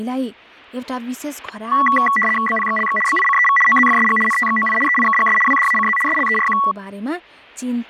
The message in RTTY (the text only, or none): BPXLX BICEV OZFSG NTXOI EIKGS WDACZ SLERQ